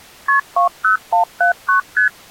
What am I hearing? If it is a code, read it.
Multi-frequency trunk signalling (R1, as on North American trunks), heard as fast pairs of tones, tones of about 120 ms. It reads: KP 20179 ST